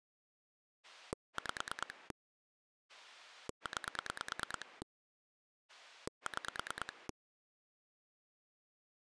Pulse dialling, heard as a rotary dial, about 9 pulses a second. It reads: 5 9 6